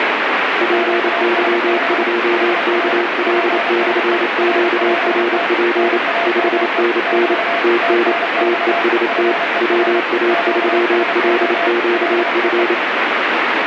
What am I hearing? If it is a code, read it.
Morse code, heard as two keyed tones, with heavy radio static. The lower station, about 28 wpm, 350 Hz: PY2KL/QRP 5NN TN TEST WA3LQF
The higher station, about 30 wpm, 680 Hz: QSB HR PSE RPT NAME <BT> TNX FER QSO LEE